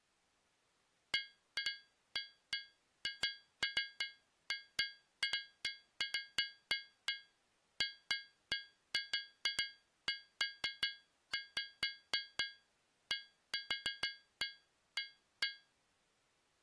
Irregular taps on a metal pipe. There is no code.